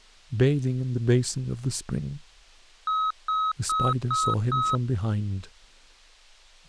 Beep code, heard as beeps, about 1280 Hz, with speech in English. 5 short. In AMI BIOS tables: processor failure; in Dell tables: CMOS battery failure.